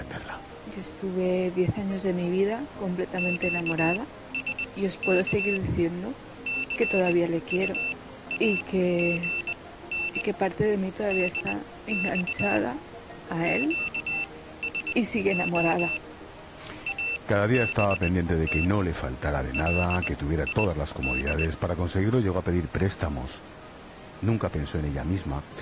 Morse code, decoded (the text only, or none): QSK CUAGN DX QSO ABT LID